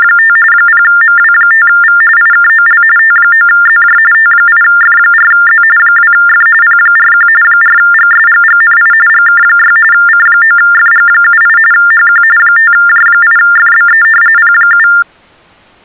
TTY/TDD text telephone tones (45.45 baud Baudot), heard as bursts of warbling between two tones, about 400 Hz shift, 1600 Hz centre. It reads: … 0MW5V IKOL T9ZJ T8F4Z 2F P41 4GSGGNI GK6 C9FG78 HQ 5J8FBE P7